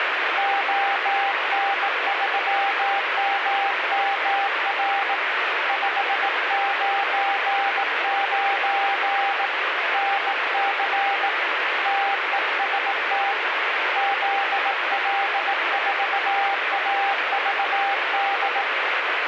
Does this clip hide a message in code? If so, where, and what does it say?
Yes: Morse code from 0.3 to 18.7 s, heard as a keyed tone, hand-sent with a bug key, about 18 wpm, 790 Hz, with radio static. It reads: ON3MMR 599 NC TEST ZL4AVD